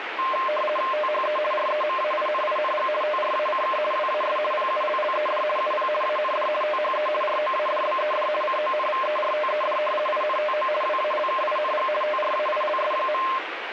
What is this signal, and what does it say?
RTTY (50 baud, 450 Hz shift), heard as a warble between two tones, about 830 Hz centre, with radio static. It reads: THE REMAINING TRACK WAS PULLED UP AND THE ROADBED CONVERTED INTO WALKING TRAILS.